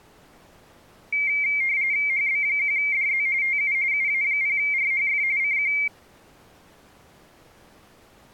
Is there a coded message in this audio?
Yes: RTTY (45.45 baud, 170 Hz shift) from 1.1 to 5.9 s, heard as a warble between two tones, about 2200 Hz centre. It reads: HB1DZ TU UA0RHF CQ